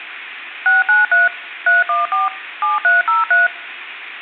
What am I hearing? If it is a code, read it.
DTMF, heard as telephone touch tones, dialled by machine, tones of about 160 ms. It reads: 693 314 7303